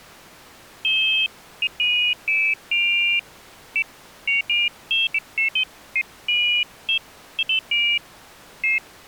Pairs of high tones at irregular times. There is no code.